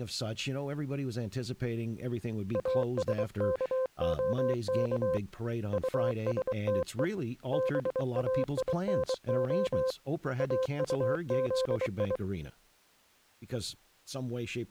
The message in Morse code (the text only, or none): ASKOK USTE BAINO AUZI